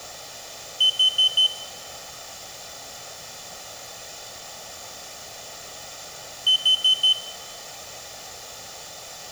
Alarm pattern, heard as an alarm's beeps, played twice, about 3050 Hz, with room echo. Temporal four. Carbon monoxide.